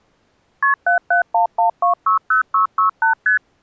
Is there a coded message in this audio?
Yes: multi-frequency trunk signalling (R1, as on North American trunks) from 0.6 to 3.4 s, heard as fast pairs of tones, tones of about 120 ms. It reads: KP 7711260668 ST